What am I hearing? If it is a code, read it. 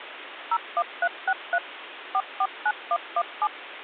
DTMF, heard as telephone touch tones, dialled by machine, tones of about 60 ms, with phone line noise. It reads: 01363 449117